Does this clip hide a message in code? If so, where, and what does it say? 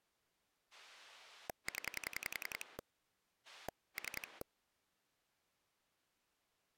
Yes: pulse dialling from 0.7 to 4.4 s, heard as a rotary dial, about 10 pulses a second. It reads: 0 3